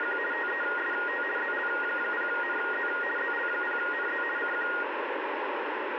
RTTY (50 baud, 450 Hz shift), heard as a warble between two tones, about 1650 Hz centre, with radio static. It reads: … TEST ZL0NZ ZL0NZ CQ